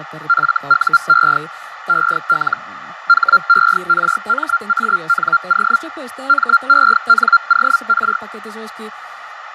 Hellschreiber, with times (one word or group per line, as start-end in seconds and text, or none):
0.3-1.4 FUE
1.9-2.6 EL
3.1-5.8 HERMANO
6.3-8.2 MENOR